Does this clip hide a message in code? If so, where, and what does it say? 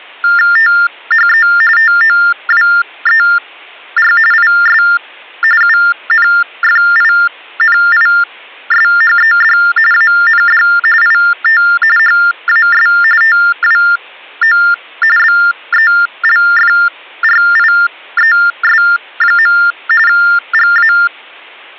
Yes: TTY/TDD text telephone tones (45.45 baud Baudot) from 0.2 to 21.1 s, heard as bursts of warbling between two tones, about 400 Hz shift, 1600 Hz centre. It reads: THE TOWER IS UNFINISHED AND IT HAS TWO BELFRIES. GA